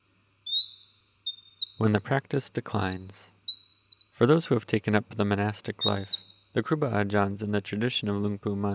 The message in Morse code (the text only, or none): none